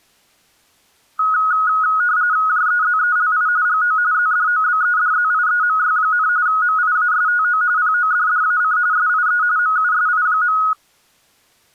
RTTY (45.45 baud, 170 Hz shift), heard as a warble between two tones, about 1360 Hz centre. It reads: JEZELI GO ZDOBEDZIEMY, MIASTO PODDAC SIE MUSI.